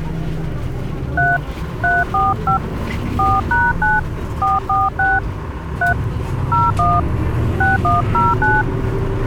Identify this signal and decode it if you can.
DTMF, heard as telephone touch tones, dialled by hand, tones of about 160 ms, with the noise inside a bus. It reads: 3 345 4#9 446 3 01 6109